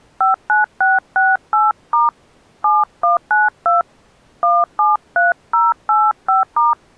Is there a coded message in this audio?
Yes: DTMF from 0.2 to 6.7 s, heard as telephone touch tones, dialled by hand, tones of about 180 ms. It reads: 59668* 7192 173085*